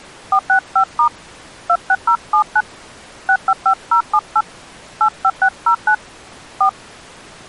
DTMF, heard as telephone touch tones, dialled by hand, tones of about 70 ms. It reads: 465* 26079 655078 85609 4